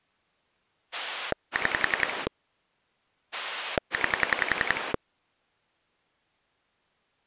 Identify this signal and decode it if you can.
Pulse dialling, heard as a rotary dial, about 11 pulses a second. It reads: 6 9